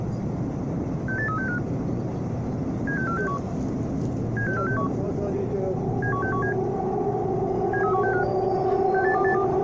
Five-tone selective call (CCIR), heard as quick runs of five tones, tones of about 100 ms, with the noise inside a subway train. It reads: 68365 76461 76461 71617 73165 68282